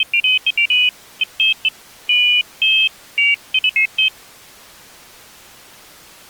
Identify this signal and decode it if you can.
Pairs of high tones at irregular times. There is no code.